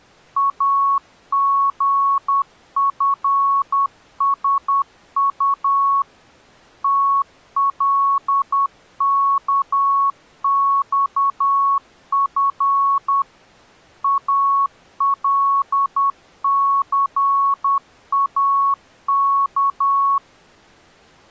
Morse code, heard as a keyed tone, machine-sent, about 10 wpm, 1110 Hz. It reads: AGFSU TLKXF ALCAK